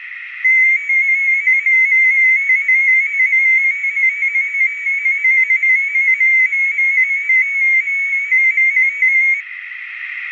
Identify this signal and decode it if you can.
Multi-tone FSK (Olivia or MFSK type), about 250 Hz wide, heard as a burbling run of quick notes, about 15.625 baud, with radio static.